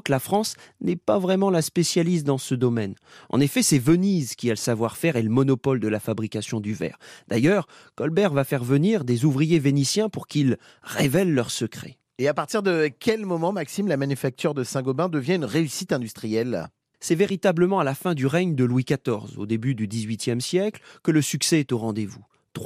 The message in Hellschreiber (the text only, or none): none